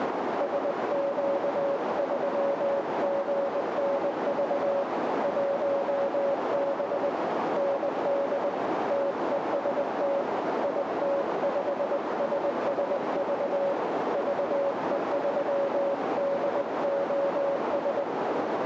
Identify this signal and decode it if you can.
Morse code, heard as a keyed tone, hand-sent with a paddle, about 20 wpm, 560 Hz, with heavy radio static and a narrow filter. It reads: SQ3GNV 1B ND TEST IT5SSV VE3DOS